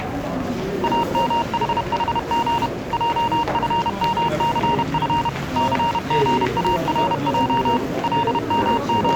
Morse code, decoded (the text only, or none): AMHHG JFMCF CGARJ …